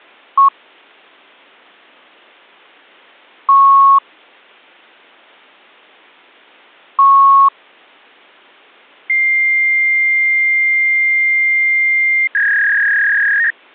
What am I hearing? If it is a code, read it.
Fax machine handshake, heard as beeps, a long tone and a warble.